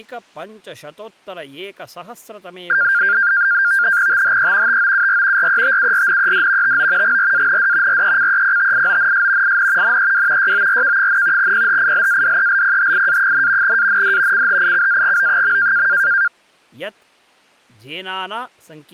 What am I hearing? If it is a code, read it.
NAVTEX (SITOR-B), 100 baud, 170 Hz shift, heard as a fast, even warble, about 1500 Hz centre, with speech in Sanskrit. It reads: THE TOUR RETURNED TO GRAND RECEPTIONS IN NEW YORK, PHILADELPHIA, AND CHICAGO.